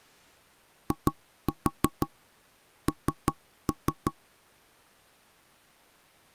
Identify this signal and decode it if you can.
Tap code, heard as knocks on wood, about 5 knocks a second. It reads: IN